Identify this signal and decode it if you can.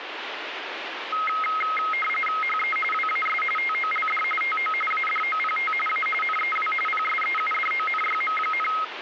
RTTY (45.45 baud, 850 Hz shift), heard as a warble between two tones, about 1700 Hz centre, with radio static. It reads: HE WAS TOLD TO ADOPT A NEW PSEUDONYM,